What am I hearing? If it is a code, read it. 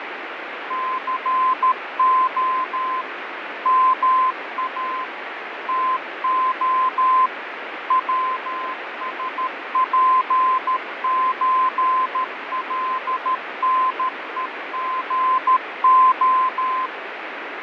Morse code (with Polish letters), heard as a keyed tone, machine-sent, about 13 wpm, 1030 Hz, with radio static and fading. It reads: CO MA TO WSPÓLNEGO